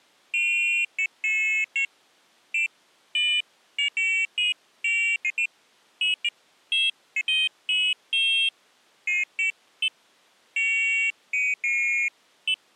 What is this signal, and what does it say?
Pairs of high tones at irregular times. There is no code.